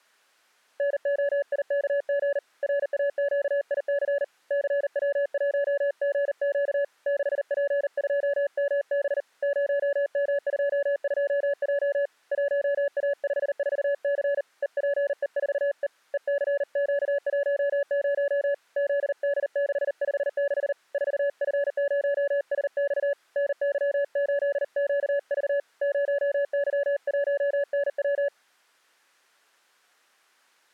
Morse code, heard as a keyed tone, hand-sent with a paddle, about 39 wpm, 570 Hz. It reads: NOIKG RAQIC CW1GQ 6P2MB 0M22J 1A54C EPE4E ECQ10 ZD656 4F0SX NY8QV 0Y1NW